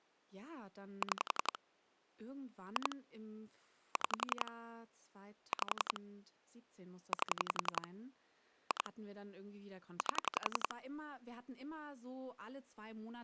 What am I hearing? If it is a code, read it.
Pulse dialling, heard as clicks on a phone line, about 11 pulses a second, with speech in German. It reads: 6 2 6 5 8 2 8